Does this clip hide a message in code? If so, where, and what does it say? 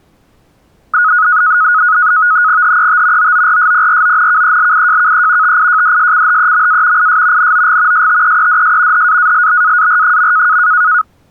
Yes: NAVTEX (SITOR-B), 100 baud, 170 Hz shift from 0.9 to 11.0 s, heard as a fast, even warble, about 1360 Hz centre. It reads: HET OORSPRONKELIJKE TIJDSCHEMA IS NOG STEEDS HAALBAAR.